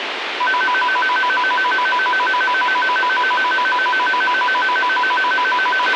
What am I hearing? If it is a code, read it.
A tone that alternates evenly between two pitches, with radio hiss and a squelch burst at the end. There is no code.